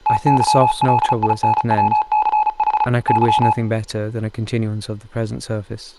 Morse code, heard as a keyed tone, machine-sent, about 35 wpm, 850 Hz, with speech in English. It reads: TYLINWCH Y